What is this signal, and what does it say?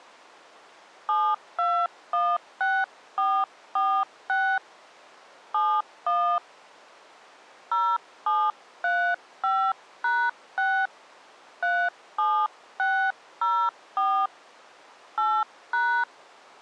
DTMF, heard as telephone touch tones, dialled by hand, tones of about 280 ms. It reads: 7216446 71 0735#6 37604 8#